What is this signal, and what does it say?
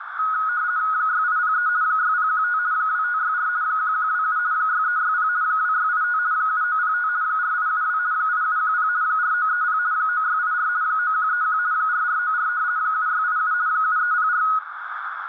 RTTY (50 baud, 170 Hz shift), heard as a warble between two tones, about 1360 Hz centre, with radio static and a narrow filter. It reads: 6803 6015 2564 1127 6360 2685 7905 4872 8710 4930 9684 9131 4494 7687 7304